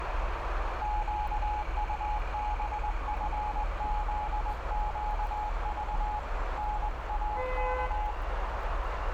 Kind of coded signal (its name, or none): Morse code